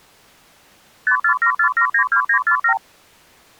Multi-frequency trunk signalling (R2, with the far end's replies), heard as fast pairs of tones, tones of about 90 ms. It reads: 5474792947